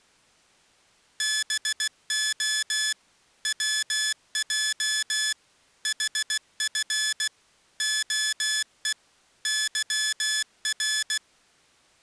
Morse code, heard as electronic beeps, machine-sent, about 16 wpm, 1700 Hz. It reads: BO WJ HF OE YR